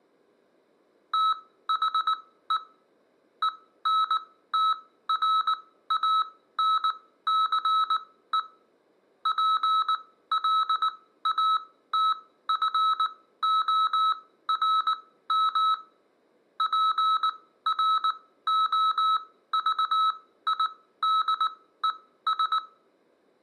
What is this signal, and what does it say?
Morse code, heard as electronic beeps, machine-sent, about 19 wpm, spaced as for 14 wpm, 1300 Hz, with room echo. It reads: THE ENTRANCE PLATFORM PROVIDES